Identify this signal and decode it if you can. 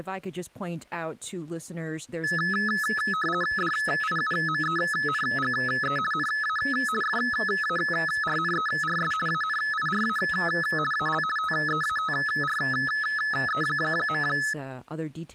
RTTY (50 baud, 450 Hz shift), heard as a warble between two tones, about 1500 Hz centre, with speech in English. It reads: DIUMENGE NA FARNERS ANIRA AL TEATRE.